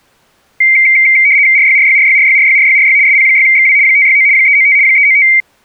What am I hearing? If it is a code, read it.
RTTY (75 baud, 170 Hz shift), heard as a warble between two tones, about 2200 Hz centre. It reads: RYRYRYRYRYRYRY SP6XW 569 395 395